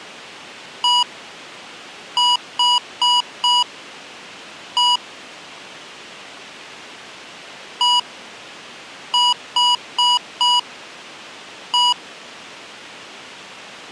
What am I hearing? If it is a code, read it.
Beep code, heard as beeps from a small speaker, played twice, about 970 Hz. 1-4-1. In Phoenix BIOS tables: address line failure in the first 64 KB of memory.